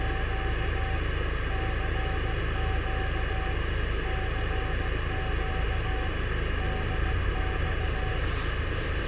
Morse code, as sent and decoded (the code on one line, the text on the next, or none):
… / -.-. --.- / -.-. --.- / -.. -..-
… CQ CQ DX